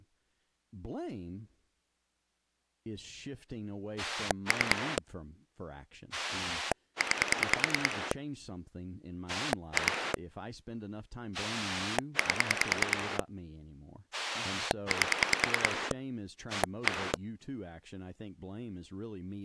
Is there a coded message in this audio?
Yes: pulse dialling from 4.0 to 17.2 s, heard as a rotary dial, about 10 pulses a second, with speech in English. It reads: 3 9 2 8 8 1